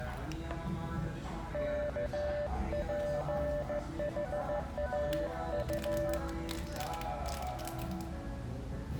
Morse code, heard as a keyed tone, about 15 wpm, 590 Hz, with the noise of a restaurant. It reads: KPHAU